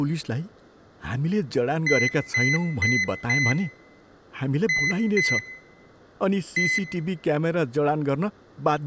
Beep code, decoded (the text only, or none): 4-2-1